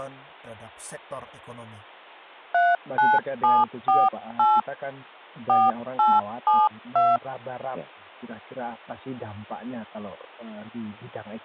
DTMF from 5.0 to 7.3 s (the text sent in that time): 4872